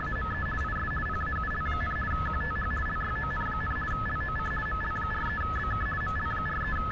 RTTY (50 baud, 450 Hz shift), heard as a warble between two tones, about 1500 Hz centre, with radio static and street noise. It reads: … IS PAUL, QTH LYON, LOC ML43BK …